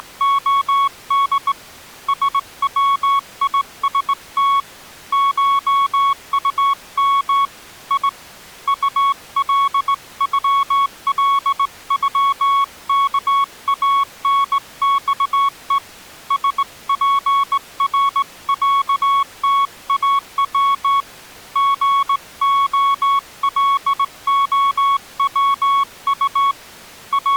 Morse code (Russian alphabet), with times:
0.0-1.5 …
2.1-4.6 СВИСТ
5.1-7.4 ШУМ
7.9-8.1 И
8.7-15.8 УЛЮЛЮКАНЬЕ
16.3-21.0 СПРЯТАВ
21.6-26.5 ГОЛОВУ
27.1-27.4 …

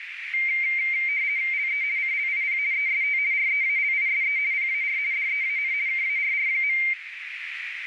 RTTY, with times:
1.5-1.8 LE
2.0-2.6 CLIP
2.7-3.2 EST
3.3-4.4 REALISE
4.5-5.0 PAR
5.1-5.7 DEAN
5.9-6.8 KARR.

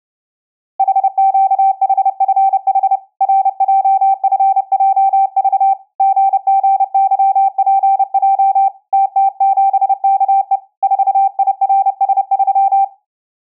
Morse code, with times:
0.8-3.0 HQHFH
3.2-5.7 RJFJV
6.0-8.7 GGYPJ
8.9-10.6 TT7KE
10.8-12.8 4IRS3

